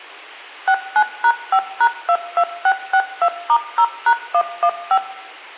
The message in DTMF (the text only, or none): 69#5#22662*0#115